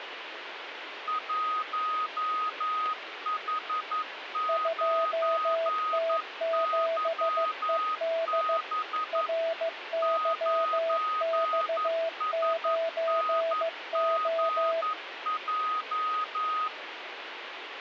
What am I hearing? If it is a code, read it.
Morse code, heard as two keyed tones, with radio static. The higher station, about 11 wpm, 1250 Hz: 1H9YB 9SNGJ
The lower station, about 15 wpm, 660 Hz: 2T7ED RYX9O